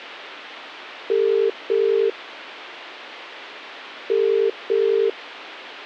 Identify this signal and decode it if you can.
Telephone call progress tone (as in the UK, Ireland, Australia and similar networks), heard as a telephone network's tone, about 400, 450 Hz. Ringback tone.